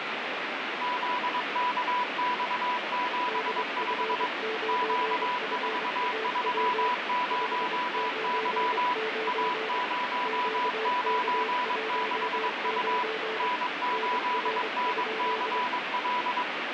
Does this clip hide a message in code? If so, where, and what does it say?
Yes: Morse code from 0.8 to 16.5 s, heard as two keyed tones, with heavy radio static. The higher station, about 22 wpm, 990 Hz: ZKX75 Q430Y A096U N8NCL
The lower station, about 24 wpm, 440 Hz: DF9FAW 599 QK19 NR?